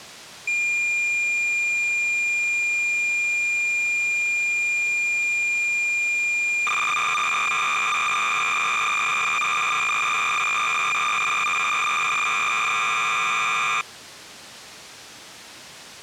Cassette data (Kansas City type), 300 baud, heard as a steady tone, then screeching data.